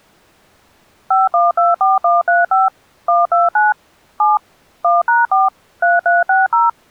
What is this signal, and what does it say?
DTMF, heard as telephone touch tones, dialled by machine, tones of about 170 ms. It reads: 5124135 129 7 1#4 3360